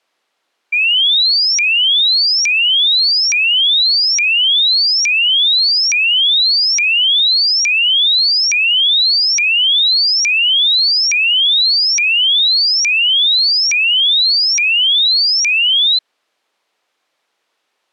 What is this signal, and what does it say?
A tone that sweeps in pitch again and again. There is no code.